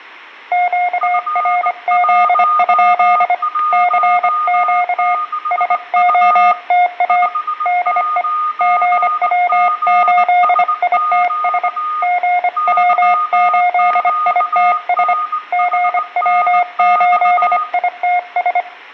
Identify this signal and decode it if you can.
Morse code, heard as two keyed tones, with static crashes and room echo. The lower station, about 25 wpm, 720 Hz: QRZ? CQ SOTA DE GW8ITS GW8ITS GW8ITS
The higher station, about 19 wpm, 1230 Hz: F116U 59GSQ YQNHNX